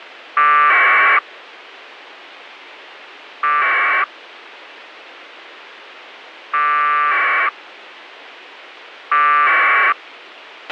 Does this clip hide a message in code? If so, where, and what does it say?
Yes: packet radio (AX.25, as in APRS), 1200 baud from 0.4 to 9.9 s, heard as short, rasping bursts, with radio hiss and a squelch burst at the end.